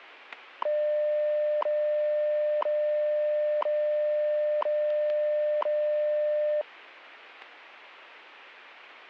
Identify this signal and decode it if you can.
Radio time signal (WWV, Colorado), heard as ticks, one a second.